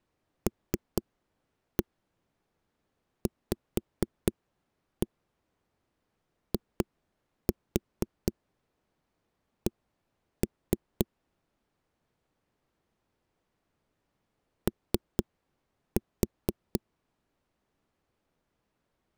Tap code, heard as knocks on a wall, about 4 knocks a second. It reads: LVIC O